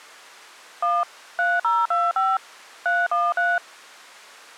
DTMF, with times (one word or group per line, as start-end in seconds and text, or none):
0.8-1.0 1
1.4-2.4 3025
2.9-3.6 313